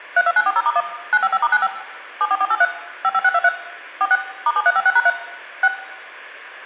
DTMF, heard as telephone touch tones, dialled by machine, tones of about 50 ms, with hum and room echo. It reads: 32940*1 955*95 74483 55623 46 *7356#3 6